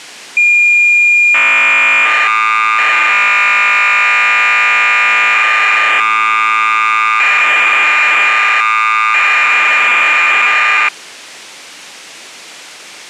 Cassette data (Kansas City type), 1200 baud, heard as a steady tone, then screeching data.